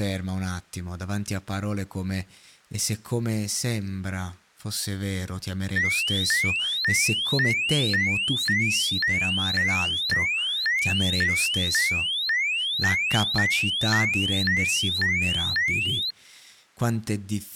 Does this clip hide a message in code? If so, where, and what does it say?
No, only a tone that sweeps in pitch again and again, with speech in Italian.